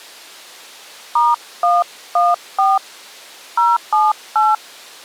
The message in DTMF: *114 078

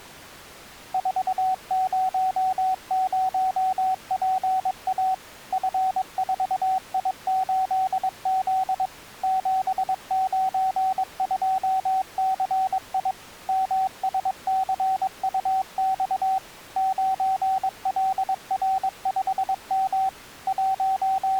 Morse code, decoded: 400PA F4I8Z 792CI MSCUX 9LR5M …

